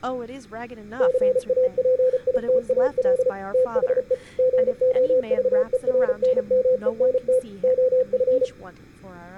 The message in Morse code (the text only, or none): CAPITAL THE GOVERNMENT OF